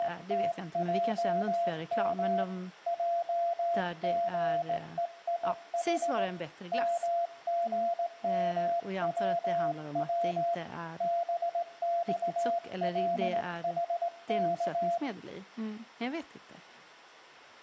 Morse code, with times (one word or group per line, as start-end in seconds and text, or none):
0.0-2.4 …
2.9-6.2 JGEIH
6.7-10.5 MGMWW
11.0-15.0 BXLHK